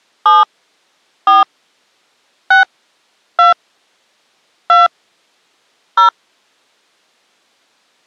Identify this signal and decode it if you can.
DTMF, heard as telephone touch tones, dialled by hand, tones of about 150 ms. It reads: 7 4 6 2 2 0